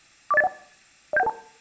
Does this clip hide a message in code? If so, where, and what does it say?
Yes: five-tone selective call (EIA) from 0.3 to 1.3 s, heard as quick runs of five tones, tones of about 30 ms, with room echo. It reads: 40801 07112